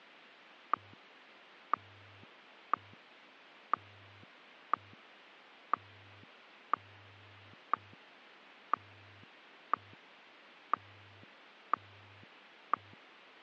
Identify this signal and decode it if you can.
Radio time signal (WWVH, Hawaii), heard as ticks, one a second.